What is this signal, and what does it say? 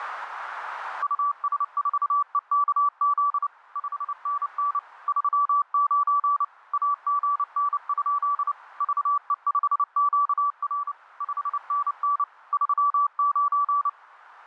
Morse code, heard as a keyed tone, machine-sent, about 29 wpm, 1150 Hz, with radio static. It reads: US4EKZ 5NN 39 AGN? VE5QR 5NN 39